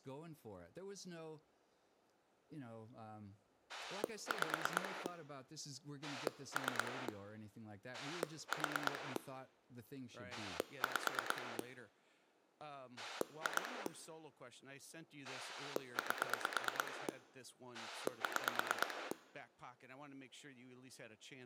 Pulse dialling, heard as a rotary dial, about 9 pulses a second, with room echo and speech in English. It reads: 5 3 4 5 2 8 6